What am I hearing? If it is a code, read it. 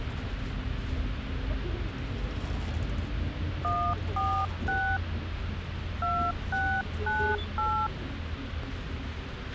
DTMF, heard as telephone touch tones, dialled by hand, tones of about 290 ms, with radio hiss, a squelch burst at the end and the noise inside a bus. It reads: 146 2698